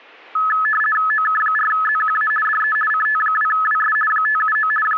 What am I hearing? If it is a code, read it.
RTTY (50 baud, 450 Hz shift), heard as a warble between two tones, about 1500 Hz centre. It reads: OK4ZQA DE CT2WS 579 …